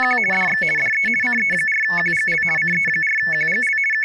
RTTY (50 baud, 450 Hz shift), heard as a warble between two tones, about 2000 Hz centre, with speech in English. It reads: … DX DE CE4QGL CE4QGL …